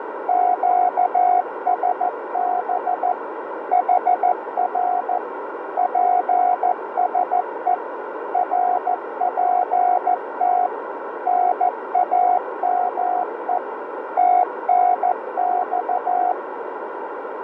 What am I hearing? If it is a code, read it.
Morse code, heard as a keyed tone, machine-sent, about 14 wpm, 720 Hz, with radio static and a narrow filter. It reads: QSB HR PSE RPT NAME TNX